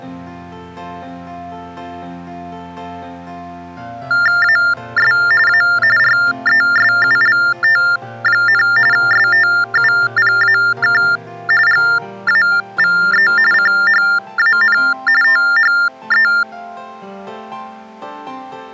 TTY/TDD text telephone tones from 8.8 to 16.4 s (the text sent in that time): STUPAK GAVE CHAN THE